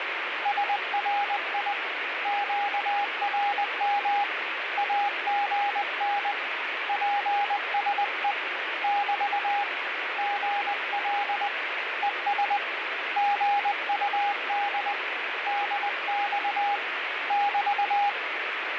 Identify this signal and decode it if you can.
Morse code, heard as a keyed tone, hand-sent with a paddle, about 20 wpm, 810 Hz, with radio static. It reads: SRI QRM AGN PSE <BT> GL ES GUD DX <BT>